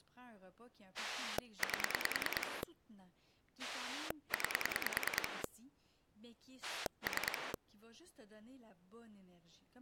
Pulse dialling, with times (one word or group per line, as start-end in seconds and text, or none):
1.0-2.6 8
3.6-5.4 9
6.6-7.5 3